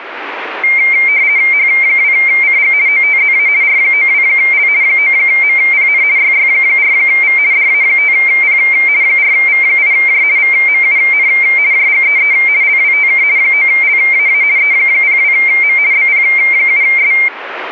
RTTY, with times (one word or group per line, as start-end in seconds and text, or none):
1.5-2.7 H2CG
2.9-3.5 OTZA
3.6-4.7 R92L
4.8-6.0 9MPN
6.2-7.4 YY4V
7.5-8.6 DA5P
9.0-10.2 4V8J
10.4-11.3 VMUN
11.7-12.3 JGEE
12.6-13.2 LWTK
13.4-14.4 9LAA
14.6-15.8 E02M
15.9-17.1 BP7S